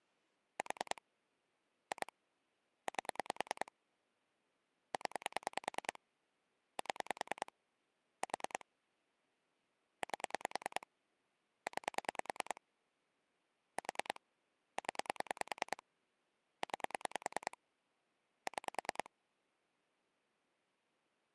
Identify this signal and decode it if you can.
Pulse dialling, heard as clicks on a phone line, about 10 pulses a second. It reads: 4 2 8 0 7 4 8 9 4 0 9 6